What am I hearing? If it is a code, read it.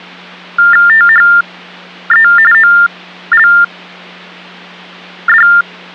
TTY/TDD text telephone tones (45.45 baud Baudot), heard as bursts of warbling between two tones, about 400 Hz shift, 1600 Hz centre, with hum. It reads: THE OLD